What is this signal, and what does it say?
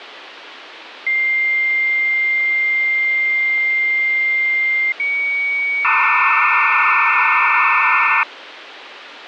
Dial-up modem handshake (low-speed, two carriers), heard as two whistles, then hiss, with phone line noise.